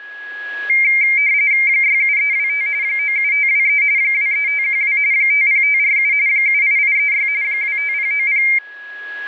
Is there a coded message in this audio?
Yes: RTTY (45.45 baud, 170 Hz shift) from 0.7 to 8.6 s, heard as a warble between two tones, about 2200 Hz centre, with a steady whistle near 1670 Hz. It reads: 67325 97523 23512 50547 78836 25090